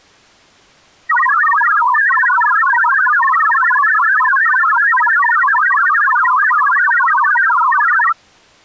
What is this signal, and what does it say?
Multi-tone FSK (Olivia or MFSK type), about 1000 Hz wide, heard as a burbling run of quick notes, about 62.5 baud.